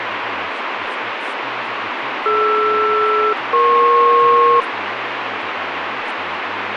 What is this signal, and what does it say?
Aircraft SELCAL, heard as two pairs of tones, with radio static and speech in English. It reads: DR-EP